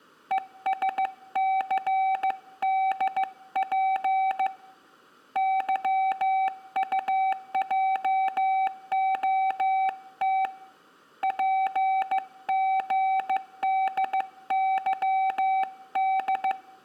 Morse code, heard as a keyed tone, hand-sent with a bug key, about 15 wpm, 770 Hz, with room echo. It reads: ESCDP YUJOT PGDYD